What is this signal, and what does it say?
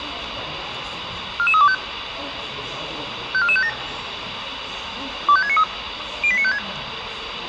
Five-tone selective call (ZVEI), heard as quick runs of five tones, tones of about 70 ms, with radio hiss and the noise of a crowd indoors. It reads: 44325 54457 25693 08956